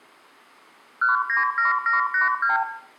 Multi-frequency trunk signalling (R2, with the far end's replies), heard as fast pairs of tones, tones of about 140 ms, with room echo. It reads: 197782